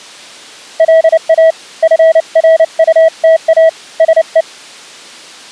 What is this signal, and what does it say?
Morse code, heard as a keyed tone, hand-sent with a paddle, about 29 wpm, 650 Hz. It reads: LA FRUTA SE